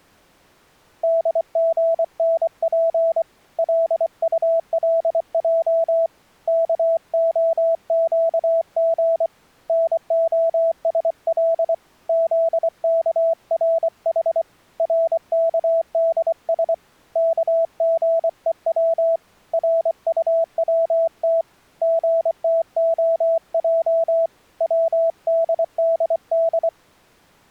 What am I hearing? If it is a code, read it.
Morse code (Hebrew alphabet), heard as a keyed tone, hand-sent with a paddle, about 24 wpm, 660 Hz. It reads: דגנף לטלע כהקג נהשל זכרח רכדש כגוץ רטצת גתהע צדדד